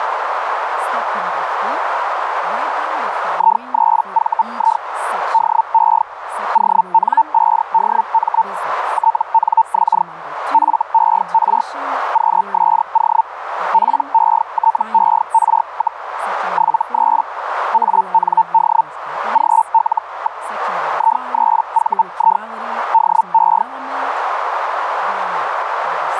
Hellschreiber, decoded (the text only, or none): I3VI DE ON5DM TNX FER QSO PETER, 73 AND GL. I3VI DE